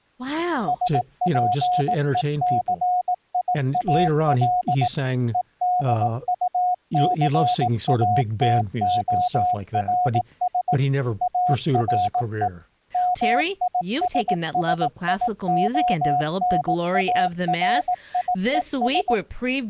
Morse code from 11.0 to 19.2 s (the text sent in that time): ARE MISSIONARIES